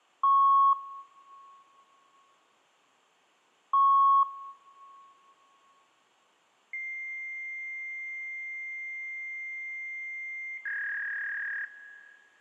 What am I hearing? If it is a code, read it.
Fax machine handshake, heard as beeps, a long tone and a warble.